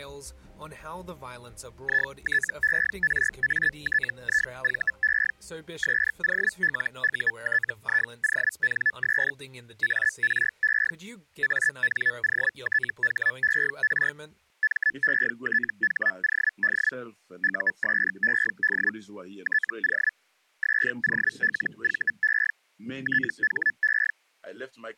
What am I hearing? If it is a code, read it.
Hellschreiber (Feld-Hell, 122.5 baud), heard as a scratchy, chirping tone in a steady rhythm, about 1750 Hz. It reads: ITERATIVE SOLUTIONS ARE ANOTHER METHOD USED TO SOLVE THE